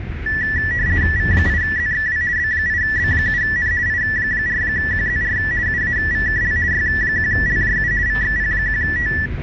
RTTY (50 baud, 170 Hz shift), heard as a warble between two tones, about 1850 Hz centre, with radio static and the noise inside a bus. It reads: V8ZXW B8B7N I4QZR UAVKL Y1LJU VXP1T